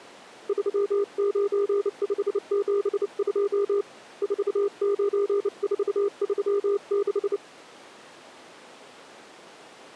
Morse code, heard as a keyed tone, hand-sent with a bug key, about 29 wpm, 400 Hz. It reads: 39572 49436